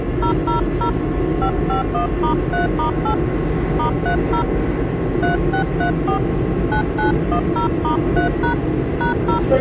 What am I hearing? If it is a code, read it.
DTMF, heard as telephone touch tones, dialled by hand, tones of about 110 ms, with the noise inside a subway train. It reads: 000 551*3*8 *30 3634 9910*3# #0